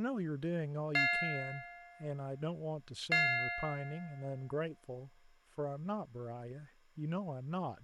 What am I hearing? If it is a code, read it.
Clock strike, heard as a bell, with speech in English. 2. Two o'clock.